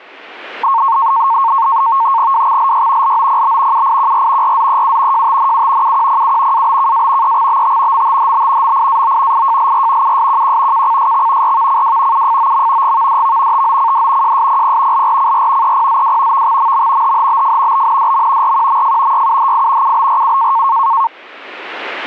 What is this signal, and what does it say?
NAVTEX (SITOR-B), 100 baud, 170 Hz shift, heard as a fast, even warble, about 1000 Hz centre. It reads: WXLY LOPB UIQR RZEU JTNU UQPU ABKA EXBT MTHB MIAO IJLR USQQ KCSX RVCW UFOM GVDV TOCD JSPP LRCR EPZW VXMM HHBF BNDM RQMF YUHI UBRU